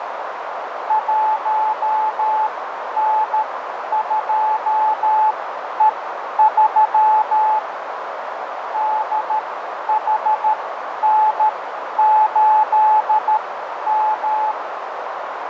Morse code, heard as a keyed tone, machine-sent, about 13 wpm, spaced as for 10 wpm, 860 Hz, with heavy radio static, fading and a narrow filter. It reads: 1N2E3 DHN8M